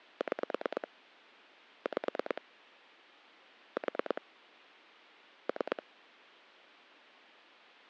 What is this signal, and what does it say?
Pulse dialling, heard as clicks on a phone line, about 9 pulses a second. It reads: 6 5 4 3